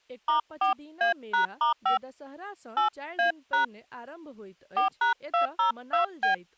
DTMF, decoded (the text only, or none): *4A#*5 8A# 4#202B